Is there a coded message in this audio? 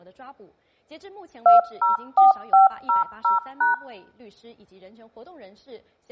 Yes: DTMF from 1.5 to 3.7 s, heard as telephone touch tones, dialled by machine, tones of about 140 ms. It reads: 204500#